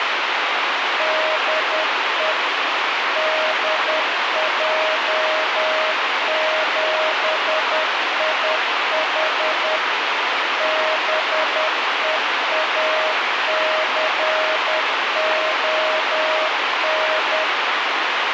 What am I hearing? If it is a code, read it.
Morse code, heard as a keyed tone, machine-sent, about 10 wpm, 630 Hz, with radio hiss. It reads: DE DJ7IH BEACON